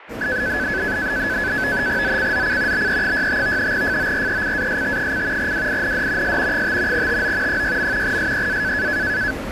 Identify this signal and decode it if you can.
NAVTEX (SITOR-B), 100 baud, 170 Hz shift, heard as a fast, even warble, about 1600 Hz centre, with radio static and the noise of a subway station. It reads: ZCZC BE65 FORECAST: WIND S 5 TO 6. SEA